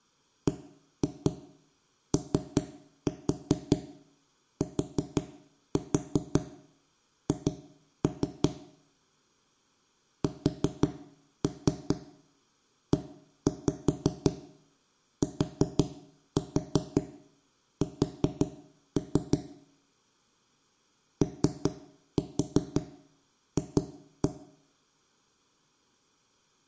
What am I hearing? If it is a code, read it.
Tap code, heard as knocks on wood, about 5 knocks a second, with room echo. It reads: BOTH SETS OF